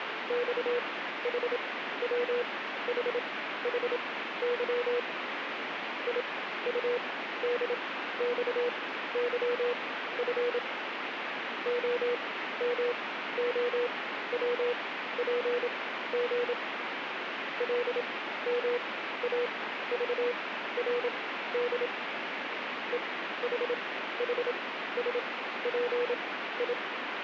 Morse code, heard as a keyed tone, machine-sent, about 27 wpm, spaced as for 14 wpm, 480 Hz, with radio static. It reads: XHWHHY IUDXYF OMOWPG LMAVRD EHHSPI